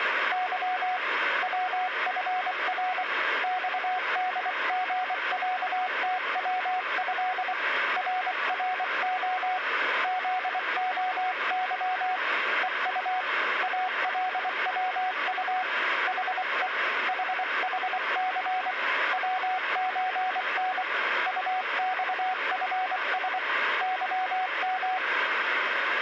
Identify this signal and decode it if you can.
Morse code (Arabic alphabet), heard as a keyed tone, hand-sent with a paddle, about 24 wpm, 740 Hz, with radio static. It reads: ظ وفر صدغعتوه ررخ ذخظ ءط الوط حء ححث وزن طصفس ظم